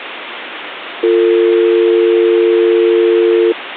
Telephone call progress tone (North American or UK plan), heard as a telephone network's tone, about 350, 450 Hz, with phone line noise. Dial tone.